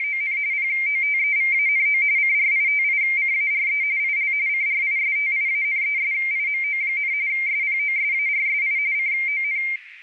RTTY (45.45 baud, 170 Hz shift), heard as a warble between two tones, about 2200 Hz centre, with radio static and a narrow filter. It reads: … POTEVANO CRITICARE IL CRISTIANESIMO, SPOSARSI CON